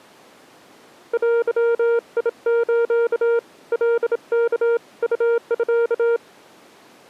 Morse code (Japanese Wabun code), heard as a keyed tone, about 27 wpm, 470 Hz. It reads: デス カワ ウミ